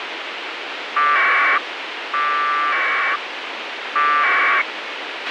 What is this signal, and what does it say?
Packet radio (AX.25, as in APRS), 1200 baud, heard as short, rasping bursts, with radio hiss and a squelch burst at the end.